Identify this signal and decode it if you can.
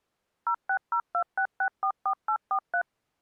DTMF, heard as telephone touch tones, dialled by machine, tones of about 80 ms. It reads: 06026644843